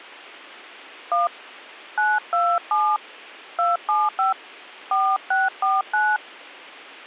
DTMF, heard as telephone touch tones, dialled by hand, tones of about 190 ms. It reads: 1 927 275 4649